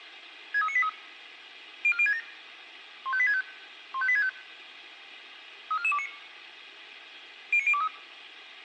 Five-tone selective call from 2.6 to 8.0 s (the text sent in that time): 15865 15865 34429 09023